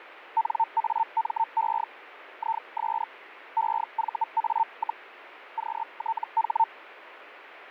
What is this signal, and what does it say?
Hellschreiber (Feld-Hell, 122.5 baud), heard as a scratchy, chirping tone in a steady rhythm, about 900 Hz, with radio static and fading. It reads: NAME IS EVA, QTH